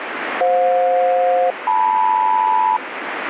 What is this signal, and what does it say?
Aircraft SELCAL, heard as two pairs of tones, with radio static. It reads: FJ-LM